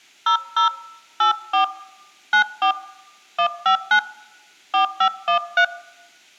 DTMF, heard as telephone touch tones, dialled by hand, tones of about 100 ms. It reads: 00 84 94 159 4513